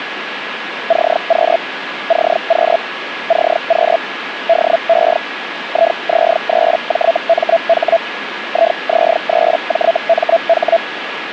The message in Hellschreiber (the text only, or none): CQ CQ CQ DE IZ3JMH IZ3JMH